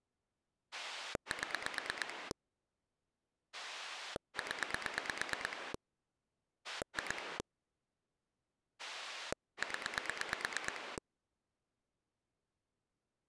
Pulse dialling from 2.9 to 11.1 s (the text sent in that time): 0 2 0